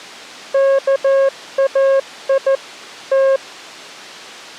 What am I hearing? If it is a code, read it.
Morse code (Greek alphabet), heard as a keyed tone, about 14 wpm, 540 Hz. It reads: ΚΑΙ Τ